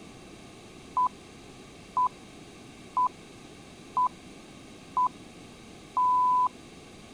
Radio time signal (six pips, as the Greenwich Time Signal), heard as pips.